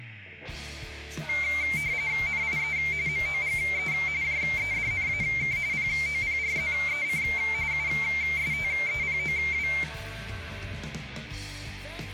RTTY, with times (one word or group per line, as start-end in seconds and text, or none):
2.3-2.8 NIE
3.1-3.9 MOGE
4.2-5.6 JEDNAK
5.7-7.2 POPRZEC
7.7-9.7 USTEPOW